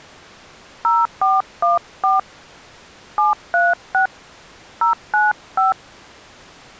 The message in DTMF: 0414 736 095

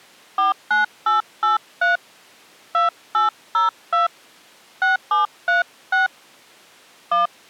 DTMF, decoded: 49883 2802 6736 1

